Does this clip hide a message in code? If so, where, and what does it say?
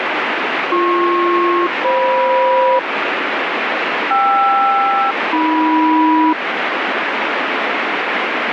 Yes: aircraft SELCAL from 0.7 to 6.3 s, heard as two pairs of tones, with heavy radio static. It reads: BP-FM KR-AM